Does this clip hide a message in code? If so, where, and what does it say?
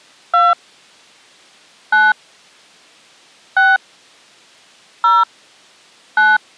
Yes: DTMF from 0.3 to 6.4 s, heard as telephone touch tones, dialled by hand, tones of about 200 ms. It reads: 2 9 6 0 9